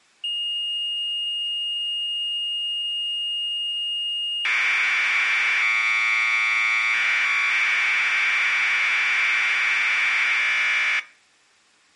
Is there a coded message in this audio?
Yes: Commodore tape loading (standard loader) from 0.2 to 11.0 s, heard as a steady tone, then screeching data.